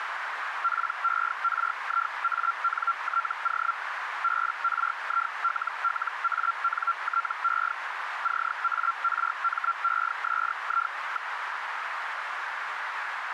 Hellschreiber (Feld-Hell, 122.5 baud), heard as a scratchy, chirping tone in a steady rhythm, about 1370 Hz, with radio static and a narrow filter. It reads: PERIANTO BRILLANTE CARMESI.